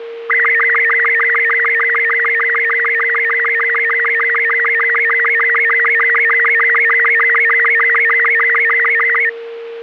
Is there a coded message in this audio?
Yes: SSTV (slow-scan television), Robot 36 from 0.3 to 9.3 s, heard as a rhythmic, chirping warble, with a steady whistle near 460 Hz.